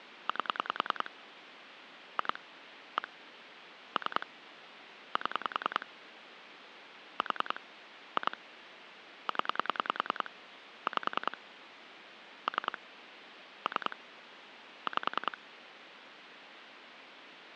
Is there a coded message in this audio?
Yes: pulse dialling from 0.3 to 15.3 s, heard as clicks on a phone line, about 10 pulses a second, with phone line noise. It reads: 8 2 1 3 7 4 2 0 5 3 3 5